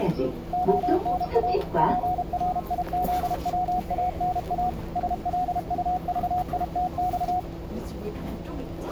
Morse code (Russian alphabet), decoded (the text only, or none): ОНА ПРИЗВАНА СЛУЖИТЬ